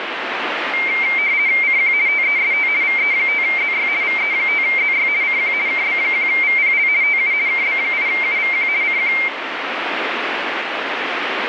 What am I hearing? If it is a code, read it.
RTTY (50 baud, 170 Hz shift), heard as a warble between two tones, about 2200 Hz centre, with radio static. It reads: CQ TEST VE5ZY VE5ZY CQ KB1VPL TU KB8UVQ CQ